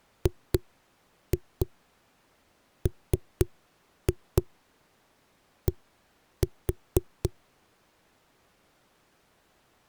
Tap code, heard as knocks on a wall, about 4 knocks a second. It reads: GMD